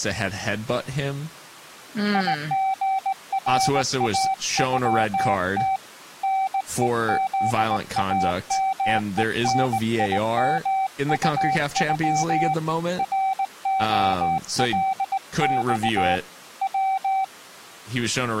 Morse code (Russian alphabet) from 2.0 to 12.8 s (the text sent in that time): ИГРАЮТ НЕЗАМЕНИМУЮ